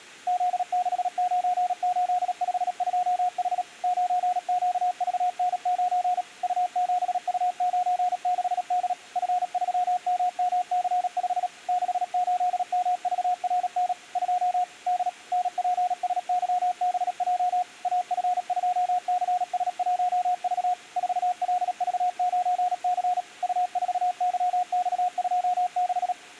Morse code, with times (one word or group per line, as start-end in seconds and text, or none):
0.3-3.6 Z69852H
3.8-6.2 9QVN9
6.4-8.9 U7U96D
9.2-11.5 F3MMC5
11.7-13.9 68MVRN
14.2-14.6 2
14.9-15.1 D
15.3-17.6 NPSYBJ
17.8-20.7 AF2CS1V
21.0-23.2 4LV9C
23.4-26.1 U4YX26